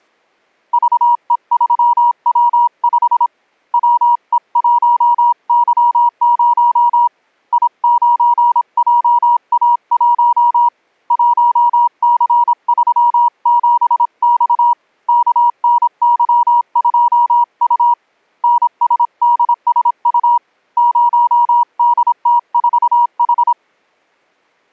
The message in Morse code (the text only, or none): VE3W5 WE1Y0 I9JA1 1C37X KNY2U NSDSU 0DT4H